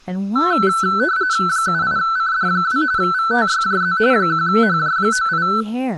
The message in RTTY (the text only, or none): 78CD2 VTYJZ 1HJ98